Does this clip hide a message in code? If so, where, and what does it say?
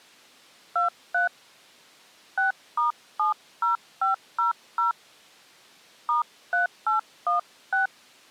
Yes: DTMF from 0.8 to 7.9 s, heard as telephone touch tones, dialled by hand, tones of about 130 ms. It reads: 23 6*70500 *3816